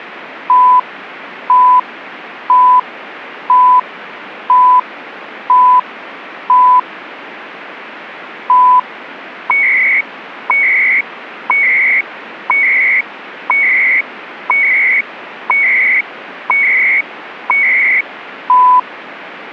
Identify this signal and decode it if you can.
Radio time signal (CHU, Canada), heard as beeps and data bursts, one a second, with radio static.